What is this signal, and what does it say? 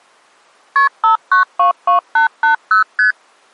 Multi-frequency trunk signalling (R1, as on North American trunks), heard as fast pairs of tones, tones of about 120 ms. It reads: KP 5922880 ST